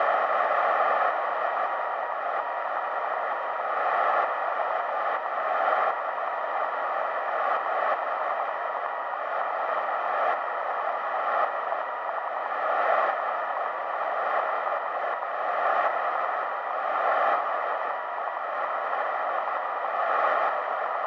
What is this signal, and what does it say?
Morse code, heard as a keyed tone, machine-sent, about 13 wpm, 960 Hz, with radio static, a narrow filter and room echo. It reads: CQ DE 2E3UKZ PSE K CQ …